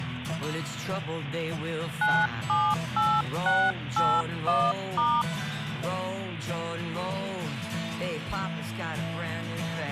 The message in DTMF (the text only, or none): 978681*